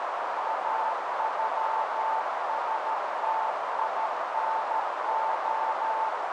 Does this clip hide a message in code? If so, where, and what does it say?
Yes: Morse code (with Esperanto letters) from 0.4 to 6.1 s, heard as a keyed tone, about 13 wpm, 890 Hz, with heavy radio static and a narrow filter. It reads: AŬSTINO